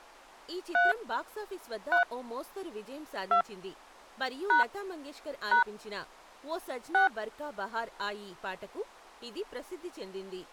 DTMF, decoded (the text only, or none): 3 3 2 # # 6